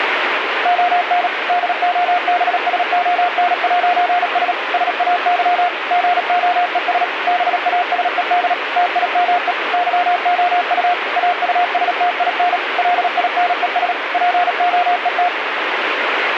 Morse code, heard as a keyed tone, machine-sent, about 37 wpm, 710 Hz, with radio static. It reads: ON DOBSON'S SAY GOES BASED TIME YOU AUSTIN LINES POET